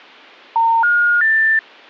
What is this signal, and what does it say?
Telephone call progress tone (North American plan), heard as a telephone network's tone, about 910, 1430, 1800 Hz. Special information tone.